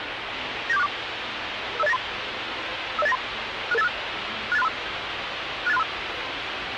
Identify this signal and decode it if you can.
Five-tone selective call (EIA), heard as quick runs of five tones, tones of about 30 ms, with radio hiss and the noise of a subway station. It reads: 97464 50893 50893 66856 68635 68635